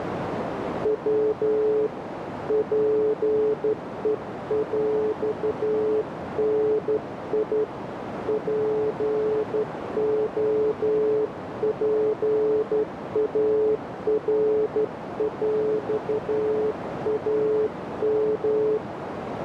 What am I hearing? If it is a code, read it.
Morse code (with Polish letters), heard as a keyed tone, hand-sent with a straight key, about 12 wpm, 430 Hz, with radio static and a narrow filter. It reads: W PEŁNI POPARŁAM